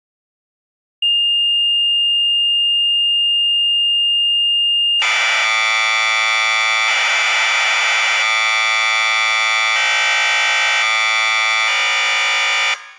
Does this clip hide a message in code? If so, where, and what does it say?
Yes: Commodore tape loading (standard loader) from 1.0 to 12.7 s, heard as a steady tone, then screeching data.